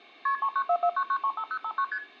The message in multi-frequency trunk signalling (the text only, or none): KP 39449935059 ST